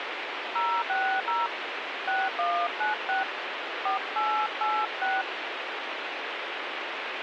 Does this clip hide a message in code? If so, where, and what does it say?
Yes: DTMF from 0.6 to 5.2 s, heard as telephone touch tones, dialled by hand, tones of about 210 ms, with radio hiss. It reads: 060 6196 4886